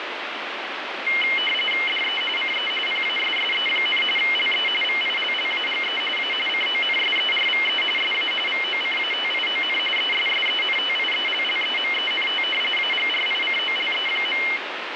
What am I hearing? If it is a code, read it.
RTTY (45.45 baud, 850 Hz shift), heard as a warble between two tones, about 2550 Hz centre, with radio static. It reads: DE CE PASSE, LE VILLAGE A CONSERVE SA VOCATION ESSENTIELLEMENT AGRICOLE.